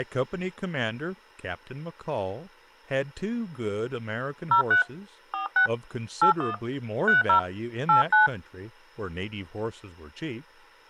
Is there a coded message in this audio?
Yes: DTMF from 4.5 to 8.3 s, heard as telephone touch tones, dialled by hand, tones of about 120 ms, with speech in English. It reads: 03 46 81 30 89